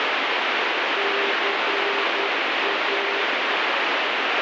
Morse code, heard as a keyed tone, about 10 wpm, 400 Hz, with heavy radio static. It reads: CA